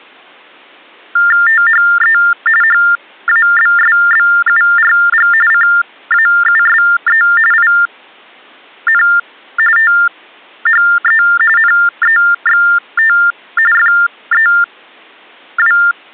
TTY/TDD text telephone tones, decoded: THE HABSBURG CAUSE IN THE NEXT FEW

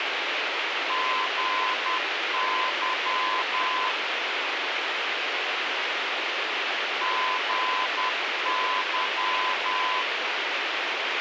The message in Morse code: GY GY

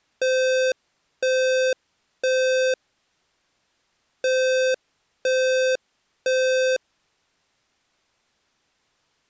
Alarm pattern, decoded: temporal three

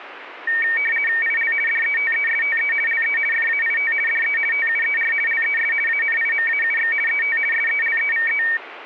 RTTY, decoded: IL DETESTE LE FAIT DE TUER LES ANIMAUX ET SELEVE

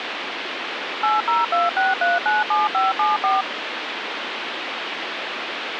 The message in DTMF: 8026397574

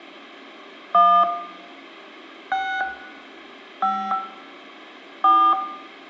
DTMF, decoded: 1 6 5 4

